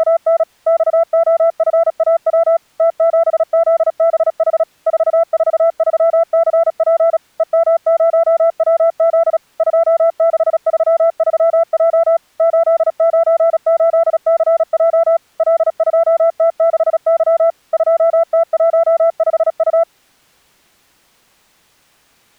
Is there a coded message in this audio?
Yes: Morse code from 0.0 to 19.9 s, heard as a keyed tone, machine-sent, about 36 wpm, 670 Hz. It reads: … XOFAW T7ZBH 443CP EM0WZ 2633J 898CJ L2T6Y 2T15U